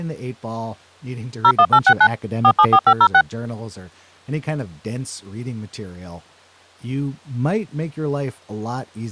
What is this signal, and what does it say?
DTMF, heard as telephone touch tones, dialled by machine, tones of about 70 ms, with speech in English. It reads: 01869 474506